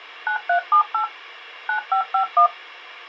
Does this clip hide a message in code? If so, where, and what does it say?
Yes: DTMF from 0.3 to 2.5 s, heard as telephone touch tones, dialled by machine, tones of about 100 ms, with a squelch burst at the end. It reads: 9378 9551